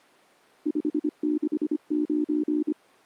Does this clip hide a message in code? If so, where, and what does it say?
Yes: Morse code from 0.6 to 2.8 s, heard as a keyed tone, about 25 wpm, 300 Hz. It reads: 569